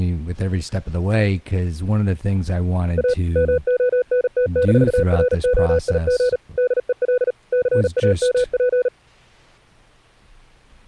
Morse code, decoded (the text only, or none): A MONT-ROIG DEL CAMP